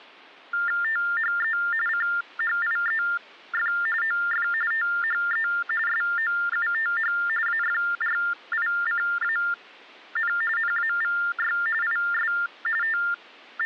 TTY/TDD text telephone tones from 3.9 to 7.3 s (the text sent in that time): OF THE SOUTH